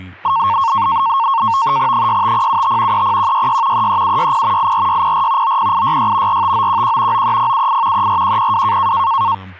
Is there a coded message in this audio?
Yes: NAVTEX (SITOR-B), 100 baud, 170 Hz shift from 0.2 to 9.3 s, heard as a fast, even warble, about 1000 Hz centre, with speech in English. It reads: 65075 30166 33760 84604 90866 45911 93078 34102